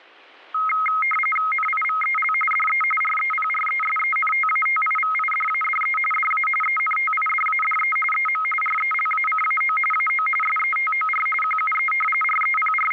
RTTY (45.45 baud, 850 Hz shift), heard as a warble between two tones, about 1700 Hz centre, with static crashes. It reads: NIVEL DE REPRESENTATIVIDADE DA ENTIDADE EM RELACAO AO SETOR QUE …